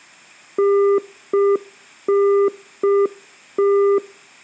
Telephone call progress tone (UK plan), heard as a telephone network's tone, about 400 Hz, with room echo. Congestion tone.